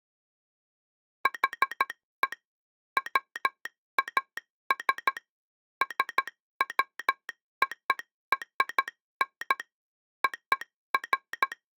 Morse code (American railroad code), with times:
1.3-2.3 HE
3.0-5.2 WAS
5.8-9.6 SWORN
10.2-11.5 OF

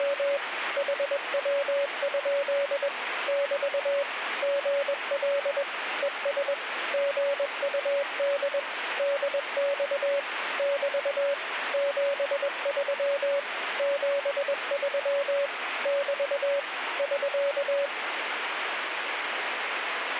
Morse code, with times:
0.0-0.4 …
0.8-2.9 HW?
3.3-4.0 <BT>
4.4-5.6 GL
6.0-6.5 ES
6.9-8.6 GUD
9.0-10.2 DX
10.6-11.3 <BT>
11.7-13.4 73
13.8-15.5 73
15.9-16.6 <BT>
17.0-17.9 <SK>

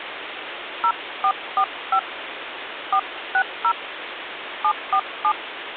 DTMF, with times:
0.8-2.0 0445
2.9-3.7 460
4.6-5.3 747

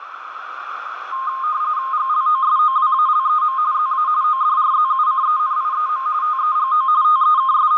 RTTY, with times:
1.9-3.6 GLOSOWALEM
3.7-4.1 ZA
4.2-6.1 ODRZUCENIEM
6.2-6.9 TEGO
7.0-7.8 …

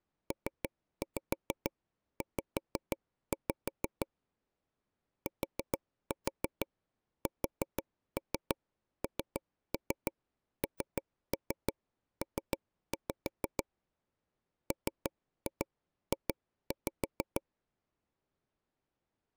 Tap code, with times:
0.3-4.1 PZ
5.3-13.6 TSNNP
14.7-17.4 MJ

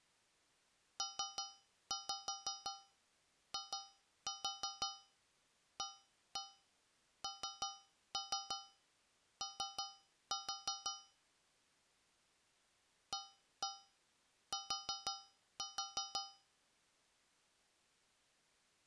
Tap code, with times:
1.0-10.9 PIANO
13.1-16.2 AT

